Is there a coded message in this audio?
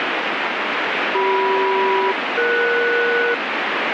Yes: aircraft SELCAL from 1.1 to 3.3 s, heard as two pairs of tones, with heavy radio static. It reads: CM-ES